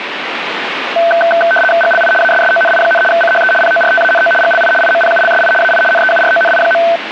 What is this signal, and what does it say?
RTTY (75 baud, 850 Hz shift), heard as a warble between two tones, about 1100 Hz centre, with radio static. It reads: GLI ASSONI, CHE PORTANO GLI IMPULSI AI NEURONI.